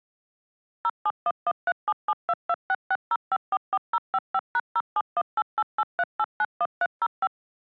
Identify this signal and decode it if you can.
DTMF, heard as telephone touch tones, dialled by machine, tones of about 50 ms. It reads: 071137722660544055#0718883891305